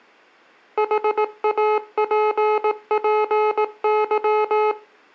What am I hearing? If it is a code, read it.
Morse code, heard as electronic beeps, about 18 wpm, 430 Hz, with room echo. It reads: HAPPY